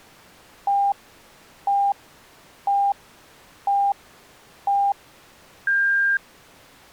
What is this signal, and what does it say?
Radio time signal (five pips and a higher one, as on Chinese radio), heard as pips.